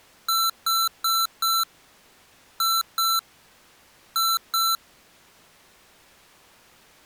Beep code, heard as beeps from a small speaker, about 1340 Hz. 4-2-2. In Phoenix BIOS tables: shutdown test failure.